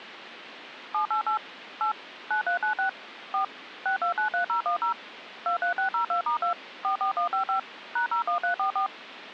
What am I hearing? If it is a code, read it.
DTMF, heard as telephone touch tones, dialled by machine, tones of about 110 ms, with phone line noise. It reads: 788 8 9396 4 6293010 23602*2 44155 #01344